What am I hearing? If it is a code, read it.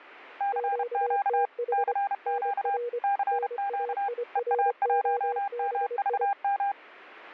Morse code, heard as two keyed tones. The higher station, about 31 wpm, 800 Hz: CQ CQ CQ EA1MVM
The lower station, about 25 wpm, 480 Hz: QTH NR NAIROBI